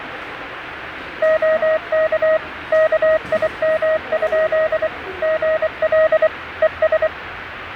Morse code, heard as a keyed tone, machine-sent, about 24 wpm, 630 Hz, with radio static and the noise of a subway station. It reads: OK KIM? GL ES